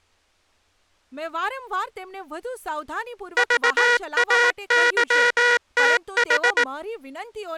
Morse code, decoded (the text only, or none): VAYTH